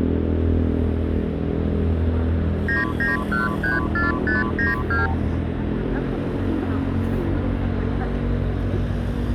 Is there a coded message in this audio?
Yes: multi-frequency trunk signalling (R2, with the far end's replies) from 2.7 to 5.1 s, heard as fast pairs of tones, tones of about 160 ms, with street noise. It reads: 99134592